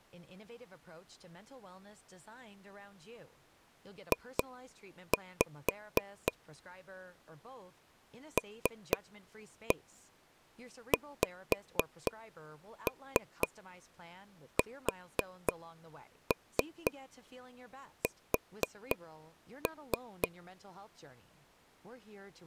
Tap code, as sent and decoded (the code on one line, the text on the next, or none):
2-5 / 3-1 5-3 4-3 4-3
J LXSS